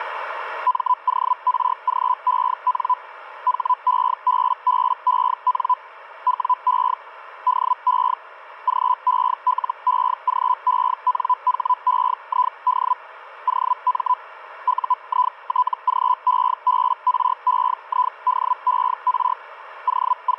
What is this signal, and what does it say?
Hellschreiber (Feld-Hell, 122.5 baud), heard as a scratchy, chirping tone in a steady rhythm, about 1000 Hz, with radio static. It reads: MORGEN HEBBEN WE DE GELEGENHEID OM UITGEBREIDER …